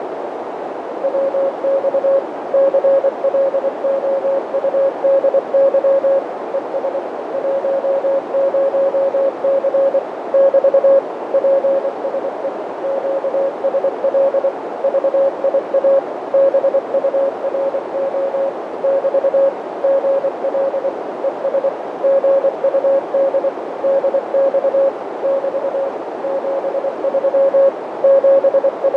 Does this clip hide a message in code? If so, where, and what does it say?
Yes: Morse code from 1.0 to 29.0 s, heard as a keyed tone, machine-sent, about 24 wpm, 550 Hz, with heavy radio static, fading and a narrow filter. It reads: WX CLOUDY ES 10C <BT> PSE QSL VIA BURO <BT> GL ES GUD DX <BT> 73 …